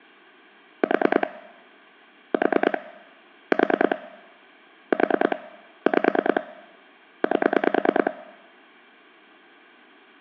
Pulse dialling, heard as clicks on a phone line, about 9 pulses a second, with room echo. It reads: 4 4 4 4 5 8